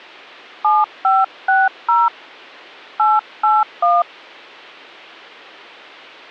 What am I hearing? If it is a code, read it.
DTMF, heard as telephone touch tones, dialled by hand, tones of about 200 ms. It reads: 7560 881